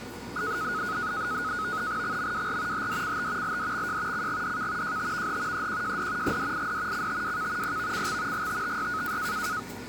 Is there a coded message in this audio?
Yes: NAVTEX (SITOR-B), 100 baud, 170 Hz shift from 0.4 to 9.6 s, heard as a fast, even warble, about 1360 Hz centre, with the noise of a cafe. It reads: XMWR HDCT LDXJ CGDK JTVH EQJD GDID CTWK PVCX GTTY